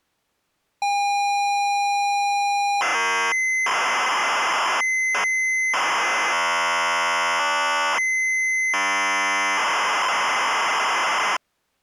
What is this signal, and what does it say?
ZX Spectrum tape loading, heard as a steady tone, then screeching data.